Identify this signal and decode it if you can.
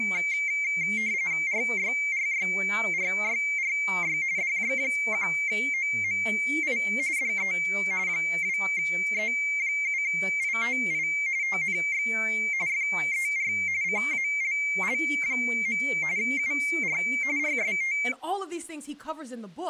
RTTY (45.45 baud, 170 Hz shift), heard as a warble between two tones, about 2200 Hz centre, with speech in English. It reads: RYRYRYRY DJ1OMI DE 2E7ITI TNX FER CALL. UR RST